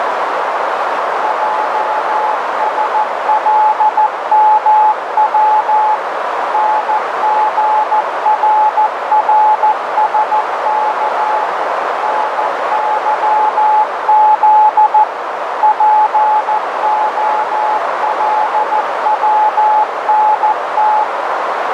Morse code, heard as a keyed tone, machine-sent, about 14 wpm, 860 Hz, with heavy radio static and a narrow filter. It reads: JSLMW NGRRSK NYZ POLWNT